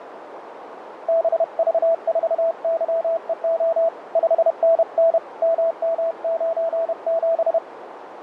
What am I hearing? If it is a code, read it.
Morse code, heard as a keyed tone, hand-sent with a paddle, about 31 wpm, 660 Hz, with radio static and a narrow filter. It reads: BV4YEO 5NN MM97